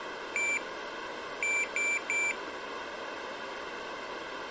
Beep code, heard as a piezo beeper, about 2350 Hz, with room echo. 1-3.